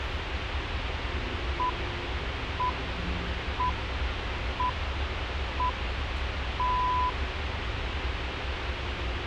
Radio time signal (six pips, as the Greenwich Time Signal), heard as pips, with radio hiss and the noise inside a bus.